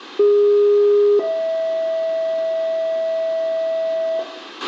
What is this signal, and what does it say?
Two-tone page, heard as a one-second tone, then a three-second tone, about 410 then 650 Hz, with a squelch burst at the end and room echo.